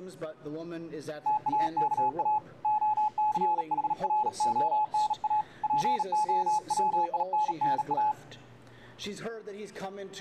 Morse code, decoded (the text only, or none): TAKA OCHRONA POWINNA